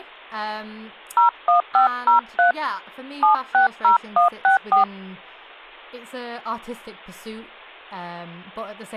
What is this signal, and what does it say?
DTMF, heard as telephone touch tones, dialled by hand, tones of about 120 ms, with speech in English. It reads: 01503 760164